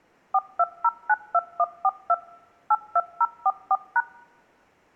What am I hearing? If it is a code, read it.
DTMF, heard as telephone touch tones, dialled by machine, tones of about 50 ms. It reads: 42092142 82044#